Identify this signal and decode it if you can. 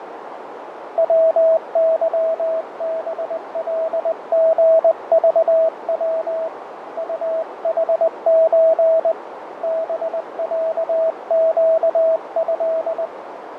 Morse code (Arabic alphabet), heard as a keyed tone, hand-sent with a paddle, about 20 wpm, 650 Hz, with radio static, fading and a narrow filter. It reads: وظبلغضو طحز بعقه